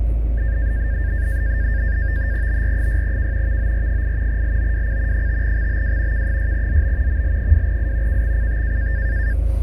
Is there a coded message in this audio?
Yes: NAVTEX (SITOR-B), 100 baud, 170 Hz shift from 0.4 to 9.3 s, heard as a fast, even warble, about 1700 Hz centre, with radio static, fading and the noise inside a car. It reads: BR6K VOR8 LOWC 5XBW K6ZB ML2I KXCT